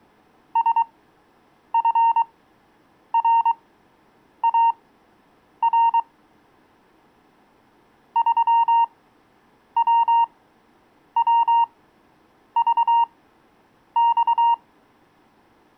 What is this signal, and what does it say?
Morse code, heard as a keyed tone, machine-sent, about 23 wpm, spaced as for 8 wpm, 930 Hz. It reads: SFRAR 3WWVX